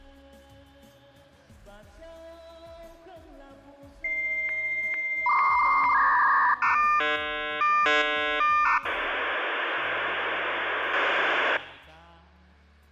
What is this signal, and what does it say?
Dial-up modem handshake (V.34 or later), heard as a whistle, warbles, then hiss.